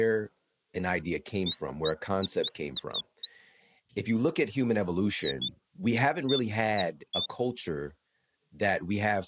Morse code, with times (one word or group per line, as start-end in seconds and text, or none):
none